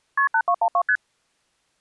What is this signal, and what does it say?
Multi-frequency trunk signalling (R1, as on North American trunks), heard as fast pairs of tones, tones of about 70 ms. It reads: KP 8212 ST